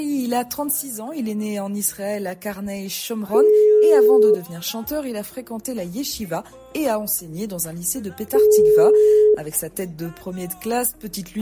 Telephone call progress tone (single-tone plan, as in most of Europe), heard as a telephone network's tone, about 420 Hz, 1 s on and 4 s off. Ringback tone.